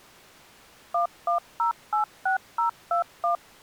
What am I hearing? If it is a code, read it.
DTMF, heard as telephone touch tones, dialled by machine, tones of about 120 ms. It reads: 11086021